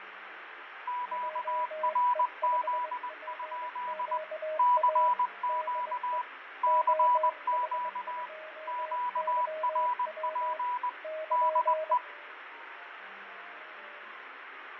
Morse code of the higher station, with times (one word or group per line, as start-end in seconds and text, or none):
0.9-4.2 QRZ?
4.6-6.2 CQ
6.6-8.3 CQ
8.7-10.9 QRP
11.3-12.0 DE